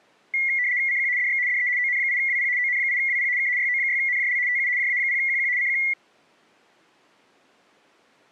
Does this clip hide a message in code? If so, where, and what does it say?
Yes: RTTY (75 baud, 170 Hz shift) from 0.3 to 5.9 s, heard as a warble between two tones, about 2050 Hz centre. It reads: CQ DX DE ON8WP ON8WP K YO6NJL TU JA0QQ CQ